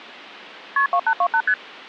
Multi-frequency trunk signalling (R1, as on North American trunks), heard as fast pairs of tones, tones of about 70 ms. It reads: KP 2828 ST